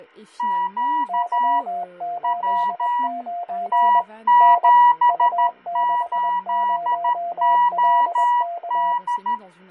Morse code, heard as two keyed tones, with fading and speech in French. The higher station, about 13 wpm, 970 Hz: Q W T78OD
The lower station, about 21 wpm, 700 Hz: Y89 N U60LK